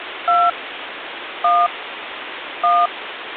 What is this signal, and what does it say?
DTMF, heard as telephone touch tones, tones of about 220 ms, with phone line noise. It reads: 2 1 1